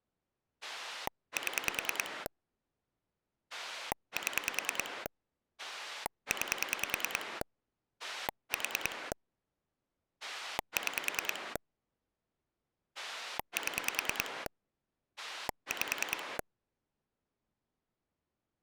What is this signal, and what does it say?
Pulse dialling, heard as a rotary dial, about 10 pulses a second. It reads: 7 7 9 4 6 7 5